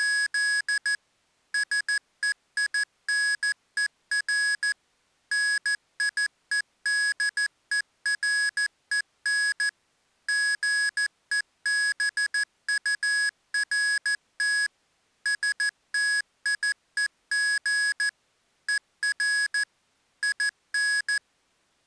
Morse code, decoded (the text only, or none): … SEINER NIEDEREN GEBURT STIEG ER IN